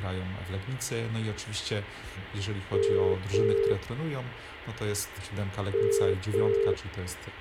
Telephone call progress tone (as in the UK, Ireland, Australia and similar networks), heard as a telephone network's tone, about 400, 450 Hz, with phone line noise. Ringback tone.